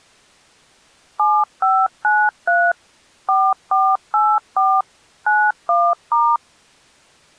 DTMF, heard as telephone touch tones, dialled by machine, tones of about 240 ms. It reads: 7593 4484 91*